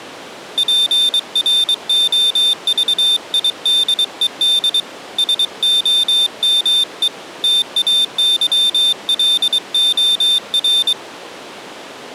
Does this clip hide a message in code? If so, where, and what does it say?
Yes: Morse code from 0.5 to 11.0 s, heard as a high beeper, hand-sent with a paddle, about 23 wpm, 3600 Hz. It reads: PROVIDED SOME TAYLOR